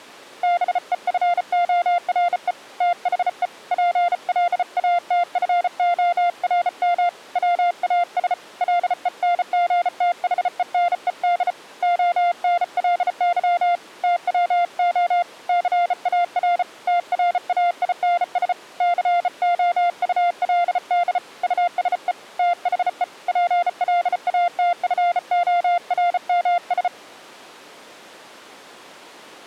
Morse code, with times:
0.4-2.5 BEFORE
2.8-3.5 THE
3.7-7.1 PLATFORM
7.4-8.3 WAS
8.6-11.5 LENGTHENED
11.8-13.8 ONLY
14.0-15.2 TWO
15.5-16.6 CAR
16.9-18.5 TRAINS
18.8-21.2 COULD
21.4-22.1 USE
22.4-23.0 THE
23.3-26.9 PLATFORMS

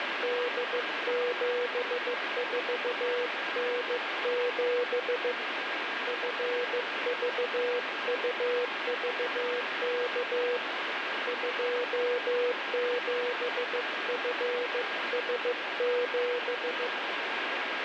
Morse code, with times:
0.2-5.3 D74N7
6.1-10.6 FVUVK
11.3-16.9 27FS7

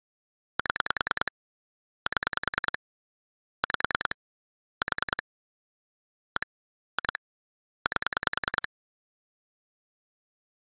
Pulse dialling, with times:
0.6-1.3 7
2.1-2.8 7
3.6-4.2 5
4.8-5.2 4
6.4-6.5 1
7.0-7.2 2
7.9-8.7 8

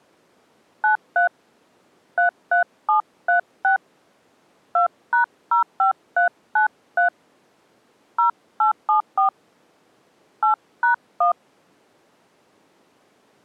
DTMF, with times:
0.8-1.3 93
2.2-3.8 33736
4.8-7.1 2#05393
8.2-9.3 0874
10.4-11.3 8#1

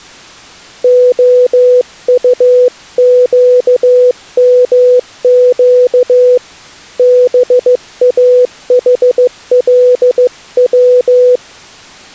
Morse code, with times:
0.8-6.4 OUQMQ
7.0-11.4 BAHLW

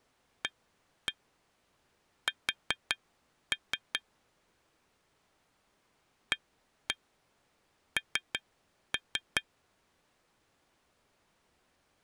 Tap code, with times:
0.4-4.0 AS
6.3-9.4 AN

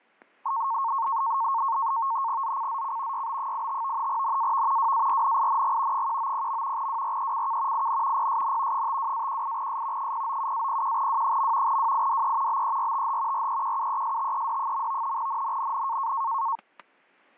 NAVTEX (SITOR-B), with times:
2.4-3.3 ZCZC
3.1-4.1 YB85
4.1-4.9 NAV
4.8-6.1 WARNING
5.9-6.9 190.
6.8-7.9 WRECK
7.7-8.3 IN
8.2-8.9 PSN
8.7-10.1 52-18S
10.0-11.8 097-01W.
11.7-12.6 WIDE
12.5-13.5 BERTH
13.3-15.2 REQUESTED.
15.2-16.1 NNNN

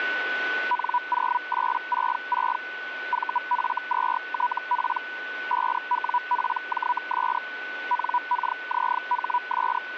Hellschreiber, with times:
0.7-2.6 N0866
3.1-5.0 VF2TP
5.5-7.4 5WPJS
7.9-9.8 NKZHS

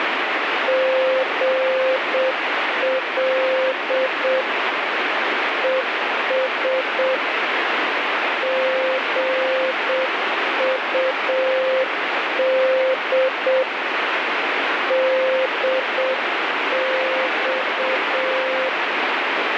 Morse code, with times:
0.7-4.4 GL
5.6-7.2 ES
8.4-13.6 GUD
14.9-18.7 DX

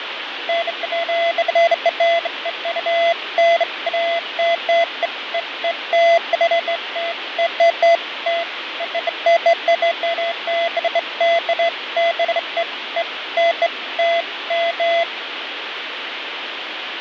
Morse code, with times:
none

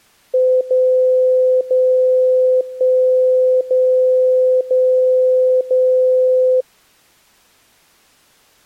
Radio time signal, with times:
0.6-1.6 0
1.6-2.6 0
2.6-3.6 1
3.6-4.6 0
4.6-5.6 0
5.6-6.6 0

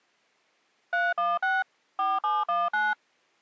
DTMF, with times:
0.9-1.6 316
2.0-2.9 4719

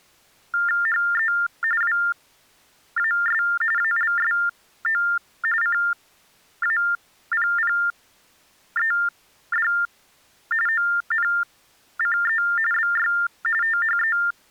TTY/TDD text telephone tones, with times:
0.9-1.3 HE
1.8-3.4 WAS
3.8-5.0 ALSO
5.6-9.7 CAPPED
10.7-12.4 ONCE
12.7-13.1 BY
13.6-14.2 THE

